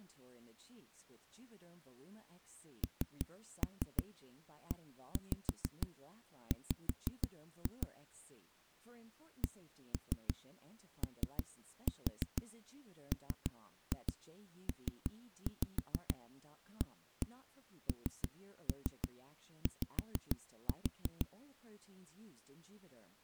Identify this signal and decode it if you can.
Tap code, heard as knocks on a wall, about 6 knocks a second, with speech in English. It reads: NEW COMPANY